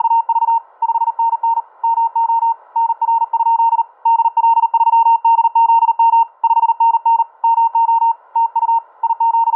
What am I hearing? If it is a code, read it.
Morse code, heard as a keyed tone, hand-sent with a paddle, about 39 wpm, 920 Hz, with static crashes. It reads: … 5NN MO NR? DL3DZM 5NN MO TU …